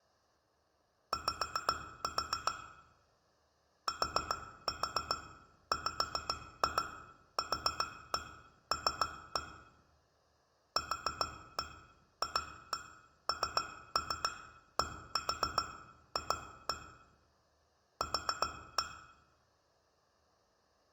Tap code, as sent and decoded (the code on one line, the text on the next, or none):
5-4 / 4-4 5-2 4-1 3-1 / 4-1 2-1 3-3 1-4 2-1 / 4-1
Y TWQL QFNDF Q